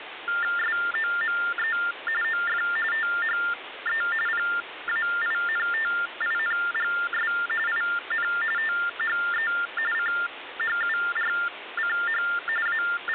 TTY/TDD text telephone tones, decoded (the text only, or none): SOME OF THE PAINTINGS IN THE CHURCH …